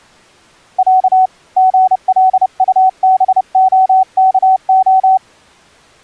Morse code (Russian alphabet), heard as a keyed tone, hand-sent with a paddle, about 30 wpm, 750 Hz. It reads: Я ГЛУБОКО